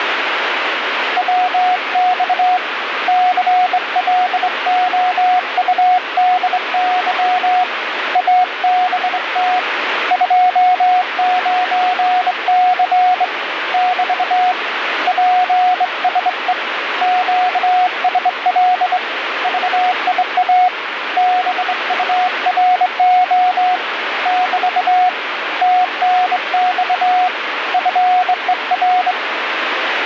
Morse code, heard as a keyed tone, hand-sent with a straight key, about 23 wpm, 730 Hz, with radio static. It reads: WX CLOUDY ABT 29C <BT> PSE QSL VIA BURO <BT> TNX FER